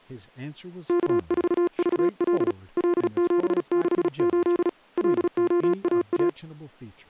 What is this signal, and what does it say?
Morse code, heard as a keyed tone, hand-sent with a paddle, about 36 wpm, 350 Hz, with speech in English. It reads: K4VL L768 LOAA